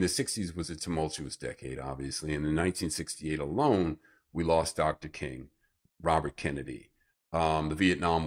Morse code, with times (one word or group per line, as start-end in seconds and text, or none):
none